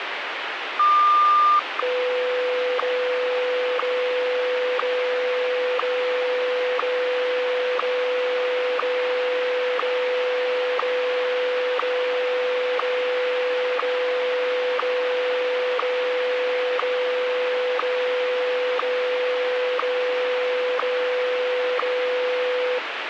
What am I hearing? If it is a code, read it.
Radio time signal (WWVH, Hawaii), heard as ticks, one a second, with radio static.